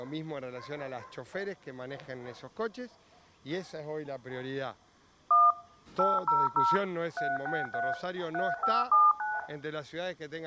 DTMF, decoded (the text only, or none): 1 800 363 3579